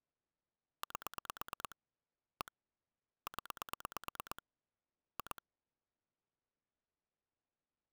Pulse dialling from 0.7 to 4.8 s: 8 1 0

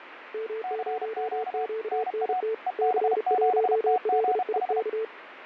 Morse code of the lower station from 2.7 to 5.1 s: C1LIK

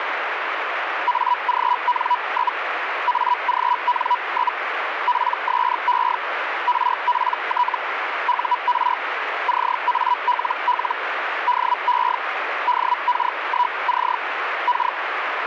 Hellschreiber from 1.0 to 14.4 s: AGN? AGN? PSE RPT UR CALL DE DK1C

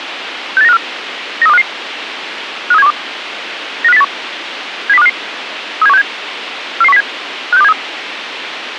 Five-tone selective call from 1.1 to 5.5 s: 93255 53712 95081 70255

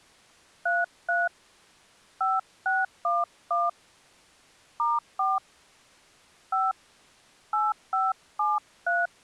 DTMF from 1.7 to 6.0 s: 5611 *4

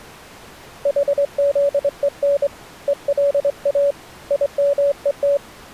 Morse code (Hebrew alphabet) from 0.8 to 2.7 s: חזון

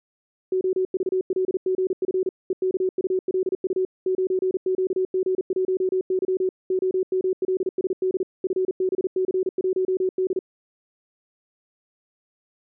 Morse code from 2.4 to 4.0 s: EKULU

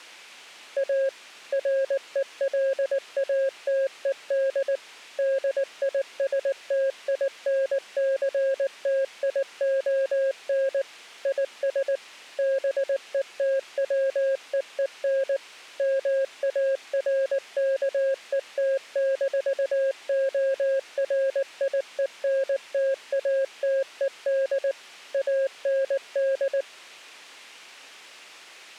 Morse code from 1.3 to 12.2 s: RELATED DISTINCTION IS

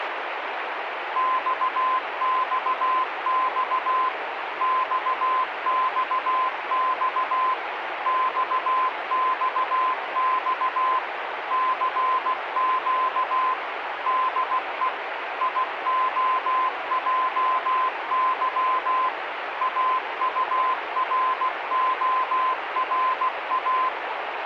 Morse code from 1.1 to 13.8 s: XXX XXX XXX CQ

